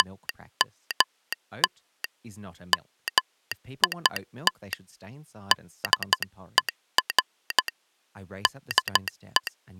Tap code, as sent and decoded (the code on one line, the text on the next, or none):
none